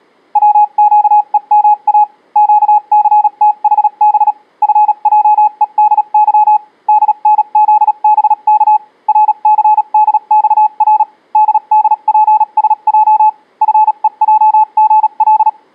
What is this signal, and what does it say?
Morse code, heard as a keyed tone, machine-sent, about 37 wpm, spaced as for 32 wpm, 850 Hz. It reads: WQEMA QCTHB FJEDY DNZBK RCDXR DDPSJ FEJGL